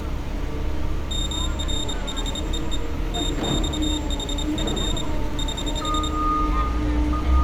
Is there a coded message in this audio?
Yes: Morse code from 1.0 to 6.1 s, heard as a high beeper, hand-sent with a paddle, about 26 wpm, 3700 Hz, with street noise. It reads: MRHEE TXHF <HH>